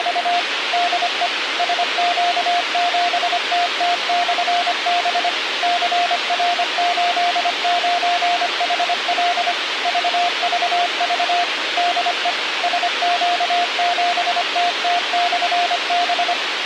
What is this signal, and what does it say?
Morse code, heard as a keyed tone, machine-sent, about 25 wpm, 700 Hz, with radio hiss. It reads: … DE SQ7TT/B CR89HL VVV DE SQ7TT/B